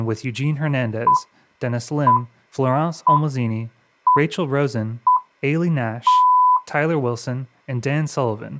Radio time signal (six pips, as the Greenwich Time Signal), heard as pips, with speech in English.